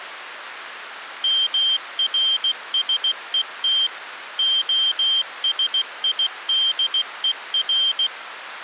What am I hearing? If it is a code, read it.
Morse code (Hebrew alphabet), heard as a high beeper, machine-sent, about 16 wpm, 3150 Hz. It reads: מרשות השידור